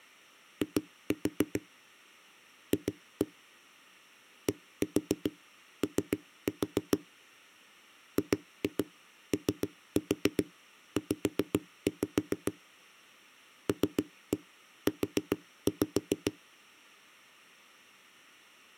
Tap code, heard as knocks on a wall, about 7 knocks a second. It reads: I F DO GOZ LU